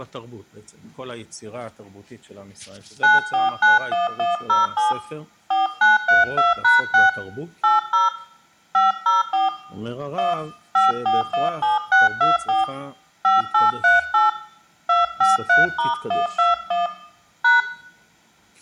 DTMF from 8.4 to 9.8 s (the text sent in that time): 504